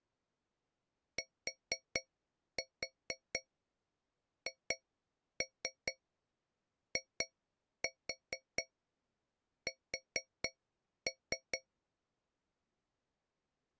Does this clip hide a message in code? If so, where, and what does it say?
Yes: tap code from 1.2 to 11.7 s, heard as taps on a metal pipe, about 4 knocks a second. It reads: THIS